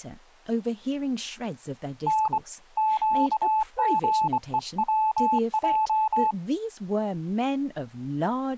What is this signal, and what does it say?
Morse code, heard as a keyed tone, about 24 wpm, 870 Hz, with speech in English. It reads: N QGEWJ